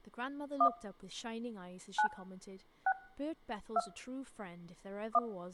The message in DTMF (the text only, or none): 1 9 6 2 1